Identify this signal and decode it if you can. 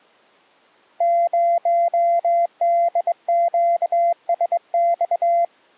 Morse code, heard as a keyed tone, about 22 wpm, 690 Hz. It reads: 0DQSX